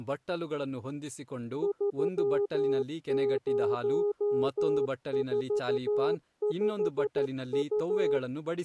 Morse code, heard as a keyed tone, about 13 wpm, 410 Hz, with speech in Kannada. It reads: 3045U